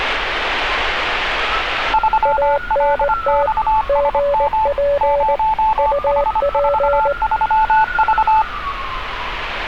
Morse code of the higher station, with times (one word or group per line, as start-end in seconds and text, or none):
1.9-4.7 3LXSM
5.0-8.4 0H43V